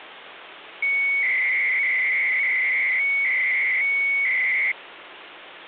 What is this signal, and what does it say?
300-baud modem data (Bell 103 tones), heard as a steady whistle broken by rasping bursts, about 300 baud, 200 Hz shift, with phone line noise.